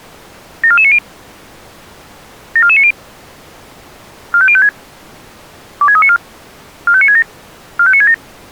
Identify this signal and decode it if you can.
Five-tone selective call (ZVEI), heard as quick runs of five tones, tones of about 70 ms. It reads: 74490 74490 45056 26394 45967 45967